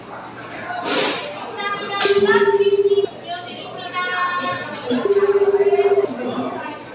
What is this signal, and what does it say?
Telephone call progress tone (Japanese plan), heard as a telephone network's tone, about 380, 400, 420 Hz, 1 s on and 2 s off, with the noise of a cafe. Ringback tone.